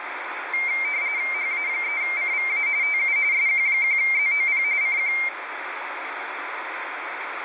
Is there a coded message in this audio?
Yes: RTTY (45.45 baud, 170 Hz shift) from 0.5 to 5.3 s, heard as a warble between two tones, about 2200 Hz centre, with radio static. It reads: HA3CVA TU SQ1ZOP CQ